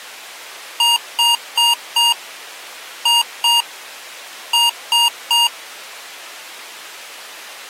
Beep code, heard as beeps from a small speaker, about 940 Hz. 4-2-3. In Phoenix BIOS tables: gate A20 failure.